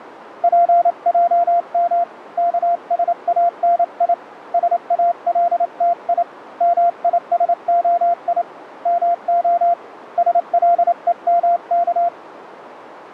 Morse code (Hebrew alphabet), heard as a keyed tone, hand-sent with a paddle, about 28 wpm, 690 Hz, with radio static. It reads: פעם כשאני שאלתי מישהי מה שלומך